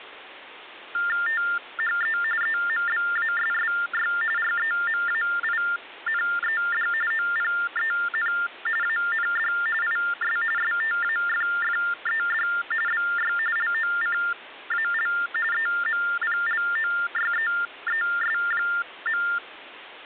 TTY/TDD text telephone tones (45.45 baud Baudot), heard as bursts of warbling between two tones, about 400 Hz shift, 1600 Hz centre. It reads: THE EMBASSY REMAINED OPEN AND IS STAFFED BY LOCAL EMPLOYEES.